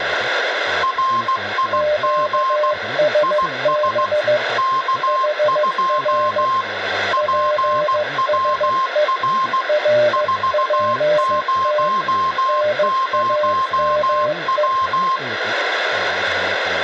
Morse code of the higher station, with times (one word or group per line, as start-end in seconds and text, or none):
0.8-2.7 RIG
3.2-4.1 IS
4.6-6.6 K2
7.1-9.6 PWR
10.1-15.2 400W